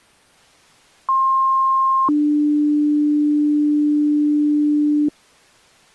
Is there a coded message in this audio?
Yes: two-tone page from 1.1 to 5.1 s, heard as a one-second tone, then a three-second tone, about 1060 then 300 Hz.